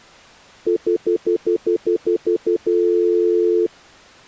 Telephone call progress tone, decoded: stutter dial tone

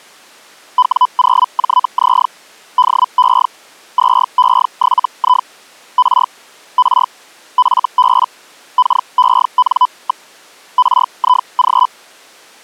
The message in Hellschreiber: W0JZ DE 2E7I R R FB KEN. RIG

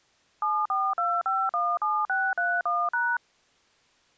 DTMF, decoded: 742517631#

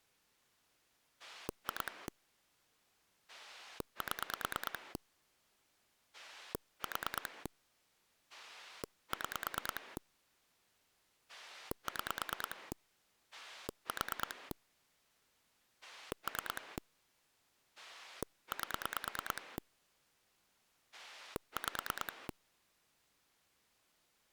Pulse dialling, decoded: 2 7 4 6 6 4 3 8 5

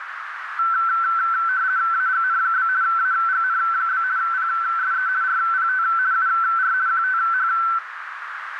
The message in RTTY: AGN? AGN? PSE RPT UR QTH

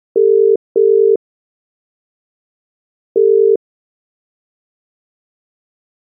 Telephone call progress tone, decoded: ringback tone

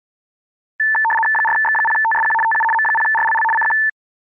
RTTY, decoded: 4X0TSQ TU M0RLL CQ

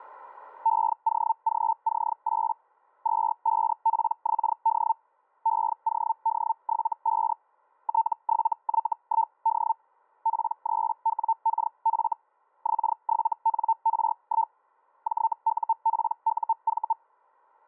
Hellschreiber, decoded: EOGC8 25PXD EOD75 T7Y1D P3WKF X7NR1 JUPUV

